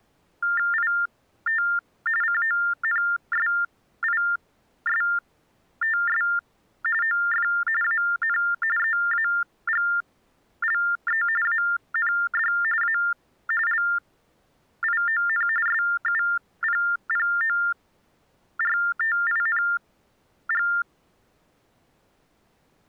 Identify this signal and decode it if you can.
TTY/TDD text telephone tones (45.45 baud Baudot), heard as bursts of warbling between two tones, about 400 Hz shift, 1600 Hz centre. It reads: IT CONSISTS OF AN EAGLE AND A LION SUPPORTING